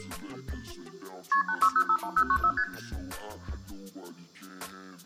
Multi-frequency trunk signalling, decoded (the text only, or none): KP 86051094 ST